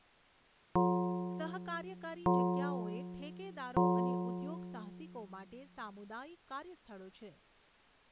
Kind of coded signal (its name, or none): clock strike